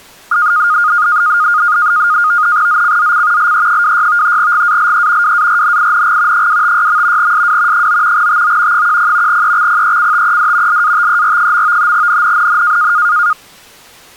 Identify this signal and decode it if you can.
NAVTEX (SITOR-B), 100 baud, 170 Hz shift, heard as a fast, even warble, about 1330 Hz centre. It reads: ZCZC LE26 GALE WARNING 256. SW 9 TO 10 EXPECTED LATER. NNNN